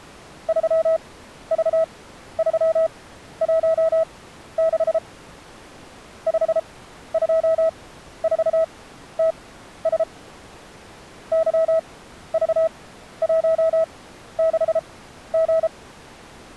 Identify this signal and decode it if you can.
Morse code, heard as a keyed tone, machine-sent, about 33 wpm, spaced as for 13 wpm, 650 Hz. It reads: 3V316 524TS YV16G